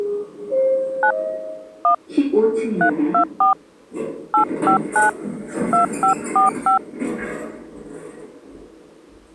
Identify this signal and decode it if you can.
DTMF, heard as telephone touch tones, dialled by hand, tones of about 110 ms, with the noise inside a lift. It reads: 9 1 324 859 2545